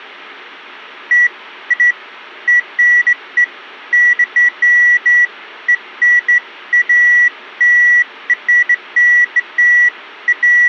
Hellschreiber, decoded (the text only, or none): none